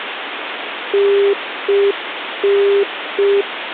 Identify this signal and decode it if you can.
Telephone call progress tone (UK plan), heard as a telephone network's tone, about 400 Hz, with phone line noise. Congestion tone.